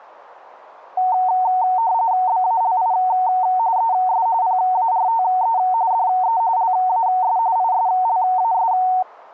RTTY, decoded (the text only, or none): BALI ES PARTE DE LAS ISLAS